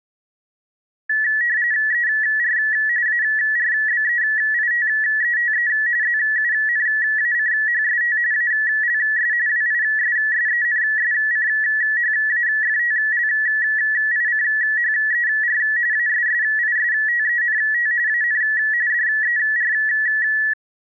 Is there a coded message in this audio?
Yes: RTTY (45.45 baud, 170 Hz shift) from 1.1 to 20.5 s, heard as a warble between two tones, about 1800 Hz centre. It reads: ER ARBEITETE ZUNACHST ALS WISSENSCHAFTLICHER ASSISTENT AN DER